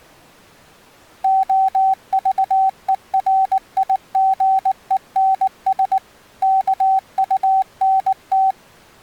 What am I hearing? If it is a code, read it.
Morse code, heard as a keyed tone, machine-sent, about 19 wpm, 770 Hz. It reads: OVERIGENS KUNT